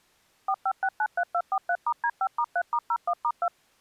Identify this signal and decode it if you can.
DTMF, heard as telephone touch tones, dialled by machine, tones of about 60 ms. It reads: 45693243*D5*3*01*2